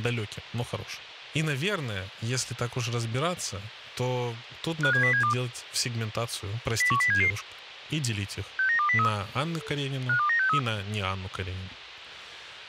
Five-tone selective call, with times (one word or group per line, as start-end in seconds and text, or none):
4.8-5.3 57072
6.8-7.3 01077
8.6-9.1 69203
10.1-10.6 52963